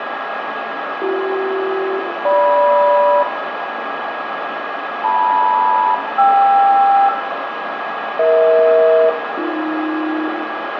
Aircraft SELCAL, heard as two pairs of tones, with radio static, a steady whistle near 1650 Hz and room echo. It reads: BC-GM LM-KR EH-AB